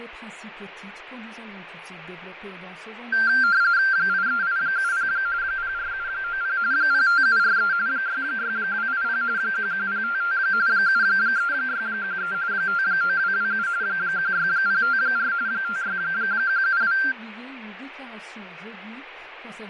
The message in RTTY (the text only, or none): 83870 04790 05743 66280 11055 73613 59227 16054 56172